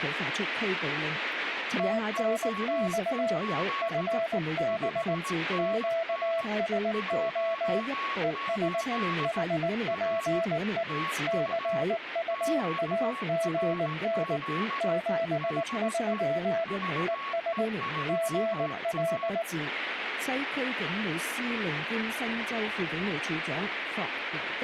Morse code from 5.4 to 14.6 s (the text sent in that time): QSO ES HPE CUAGN